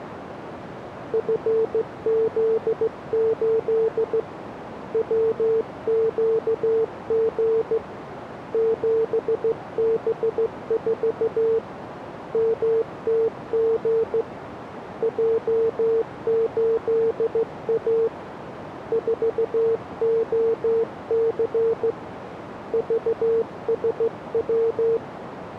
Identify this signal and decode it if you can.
Morse code, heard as a keyed tone, hand-sent with a straight key, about 15 wpm, 450 Hz, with radio static and a narrow filter. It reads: FZ8 WQG 7B4 MTG J8A 4OC VSW